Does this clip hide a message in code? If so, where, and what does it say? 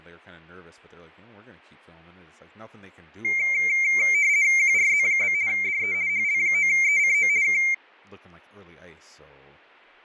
Yes: RTTY (50 baud, 170 Hz shift) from 3.2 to 7.7 s, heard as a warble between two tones, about 2200 Hz centre, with fading and speech in English. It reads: QRZ? DE HL9ECO K